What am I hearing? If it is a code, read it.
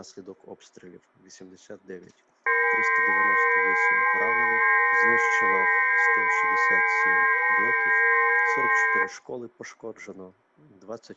FT8 (several signals at once), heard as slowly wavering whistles, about 6.25 baud.